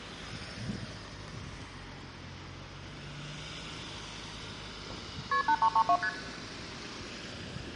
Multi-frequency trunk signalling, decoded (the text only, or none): KP 8332 ST